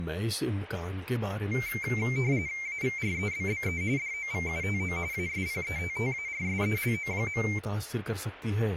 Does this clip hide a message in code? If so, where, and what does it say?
Yes: RTTY (45.45 baud, 170 Hz shift) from 1.5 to 7.6 s, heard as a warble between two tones, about 2200 Hz centre, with speech in Urdu. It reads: AVREBBE DOVUTO ASPETTARSELO.